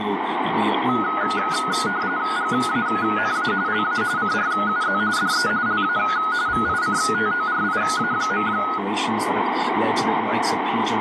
RTTY (45.45 baud, 170 Hz shift), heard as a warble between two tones, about 1360 Hz centre, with radio static. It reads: GANA LA CRUZ DE LA VICTORIA.